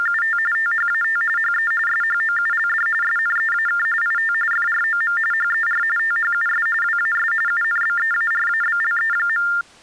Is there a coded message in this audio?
Yes: TTY/TDD text telephone tones (45.45 baud Baudot) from 0.0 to 9.6 s, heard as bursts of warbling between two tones, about 400 Hz shift, 1600 Hz centre. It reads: … THAT HE SHOULD SNEAK IT FROM HER THUS WAS UNBEARABLE.